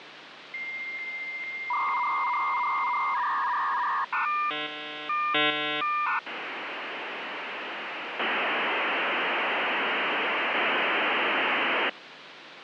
Dial-up modem handshake (V.34 or later), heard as a whistle, warbles, then hiss, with phone line noise.